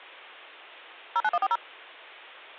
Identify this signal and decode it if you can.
DTMF, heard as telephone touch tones, dialled by machine, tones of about 40 ms. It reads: 09140